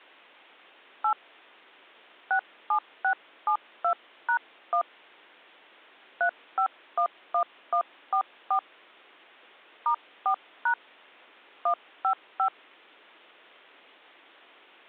DTMF, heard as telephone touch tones, dialled by hand, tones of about 90 ms. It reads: 8 67672#1 3511144 *4# 155